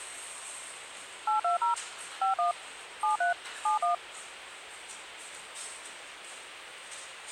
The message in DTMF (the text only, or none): 820 51 73 71